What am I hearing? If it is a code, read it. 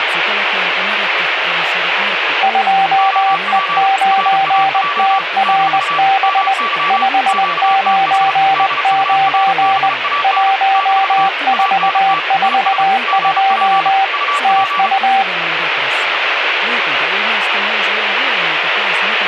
Morse code, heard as two keyed tones, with radio static and speech in Finnish. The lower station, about 20 wpm, 780 Hz: 2E9TRB 599 1442 TU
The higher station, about 34 wpm, 1150 Hz: OP RAJ - MY QTH DURBAN - ANT IS GP UP